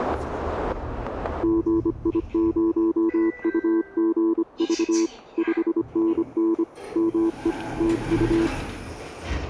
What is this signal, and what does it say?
Morse code, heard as a keyed tone, hand-sent with a bug key, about 25 wpm, 330 Hz, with static crashes and the noise inside a lift. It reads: GI0UGV 5NN ME TU